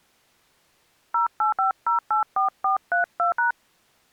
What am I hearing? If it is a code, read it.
DTMF, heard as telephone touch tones, dialled by hand, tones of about 120 ms. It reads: 085084432#